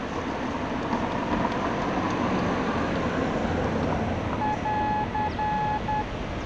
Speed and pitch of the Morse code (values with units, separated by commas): 10 wpm, 850 Hz